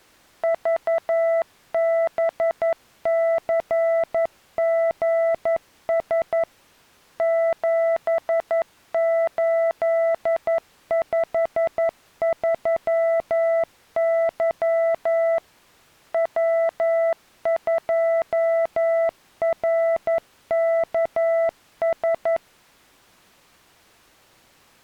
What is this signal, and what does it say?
Morse code, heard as a keyed tone, machine-sent, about 11 wpm, 660 Hz. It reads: VBCGS 7853Y W2RKS